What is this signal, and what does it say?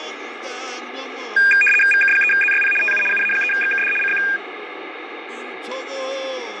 RTTY (75 baud, 850 Hz shift), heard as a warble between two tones, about 2000 Hz centre, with radio static and fading. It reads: VK3ZYP TU UA3XKD CQ